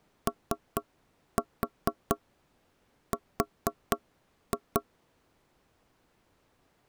Tap code, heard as knocks on wood, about 4 knocks a second. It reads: OR